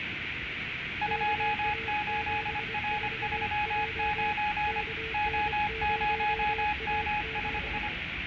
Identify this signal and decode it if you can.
Morse code, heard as two keyed tones, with radio static, room echo and the noise inside a subway train. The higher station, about 25 wpm, 840 Hz: 28R39 O0MSI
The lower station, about 24 wpm, 450 Hz: KA74J KN0AZ